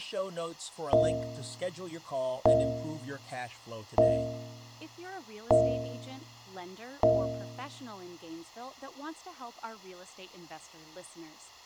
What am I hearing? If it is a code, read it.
Clock strike, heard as a bell, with room echo and speech in English. 5. Five o'clock.